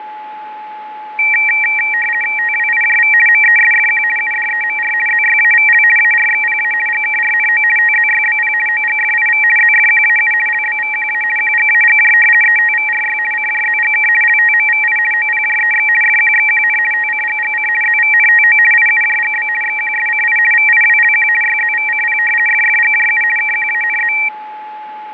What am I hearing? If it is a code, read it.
RTTY (50 baud, 450 Hz shift), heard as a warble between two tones, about 2100 Hz centre, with a steady whistle near 850 Hz. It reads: TWIJV MESFQ UDEMR ZYAVL ARXPA GKRNO TZYBP OGFIV ZFQAU LBVQA QGAGJ ETVRY CJZGK LTMVI OPJEX FQXQN TCGGC ZVNTO IUJGB XQSCI VIWLQ YZVCP FFGJU KQANZ